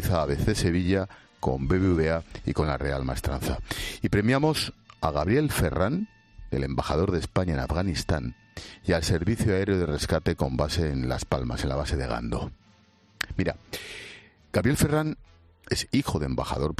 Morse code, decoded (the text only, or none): none